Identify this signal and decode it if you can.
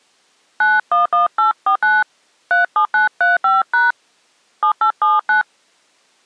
DTMF, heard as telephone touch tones, dialled by hand, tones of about 150 ms. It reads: 911849 37935# 7879